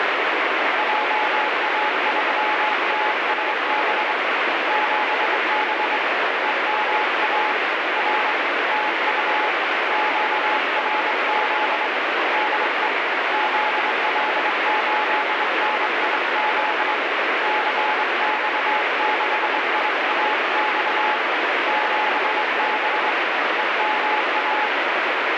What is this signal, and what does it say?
Morse code, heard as a keyed tone, hand-sent with a straight key, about 23 wpm, 850 Hz, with heavy radio static. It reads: JA3TSB 7B EMA R TU QRZ DE ZL8NIZ CX6IAX 7B EMA